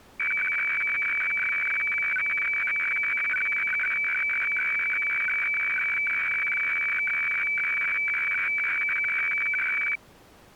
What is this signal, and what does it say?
Weather fax (radiofax), 120 lines a minute, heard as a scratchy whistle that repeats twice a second.